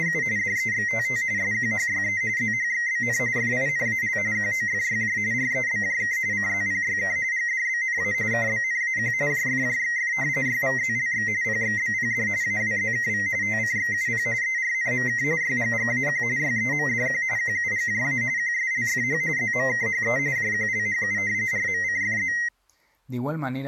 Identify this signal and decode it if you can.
RTTY (45.45 baud, 170 Hz shift), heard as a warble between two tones, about 2000 Hz centre, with speech in Spanish. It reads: … DEXTT SQHYE ZHXBN FINAL QOFYJ REBJK CZPYK GDBNA KBNAQ JFJXF YVZLX PXBPD AWZKV TCXUP ERNMK YGGAQ YEMDQ QUGJA QSLFH ZMKHE JQLHU RMCFZ